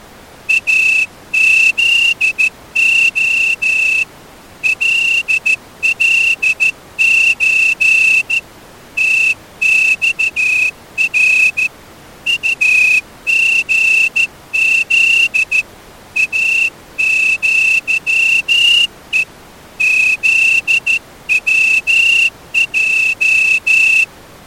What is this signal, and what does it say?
Morse code (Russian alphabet), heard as a whistle, hand-sent with a straight key, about 14 wpm. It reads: АЗО ЛЛЧ ТЬР УГЗ АЪЕ ЗВЙ